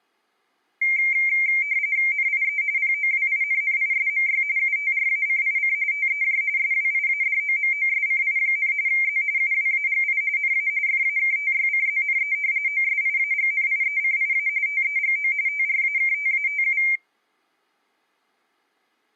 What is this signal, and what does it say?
RTTY (45.45 baud, 170 Hz shift), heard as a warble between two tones, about 2200 Hz centre. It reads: NIE POWINNISMY UTRACIC TEJ SWIADOMOSCI, Z UWAGI NA FAKTYCZNE OSIAGNIECIA TEGO TRAKTATU